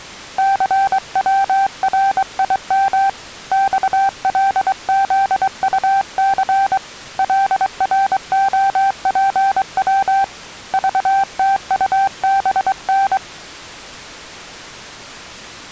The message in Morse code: CWRIM XLZUC LROPW VTUBN

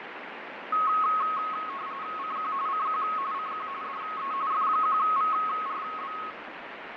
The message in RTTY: CQ CQ CQ DE F1VRB

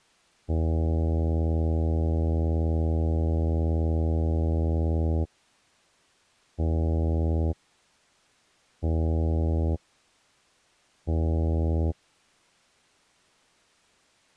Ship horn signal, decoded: 1 long, 3 short

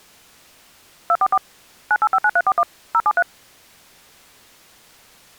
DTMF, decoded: 244 9859341 073

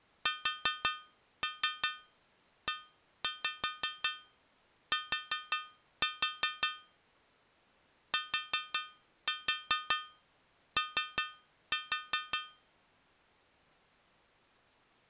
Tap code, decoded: SET TO

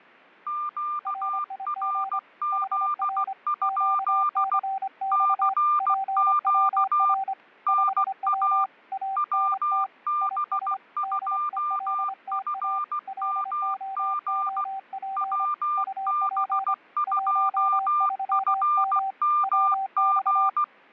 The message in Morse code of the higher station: QRZ? CQ NA WB2FMG WB2FMG

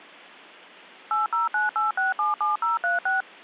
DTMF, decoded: 8098677036

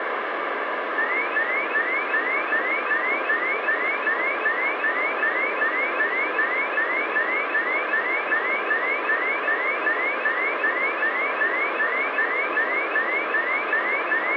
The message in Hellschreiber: none

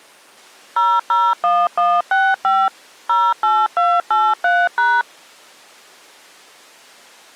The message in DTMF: 001165 08283#

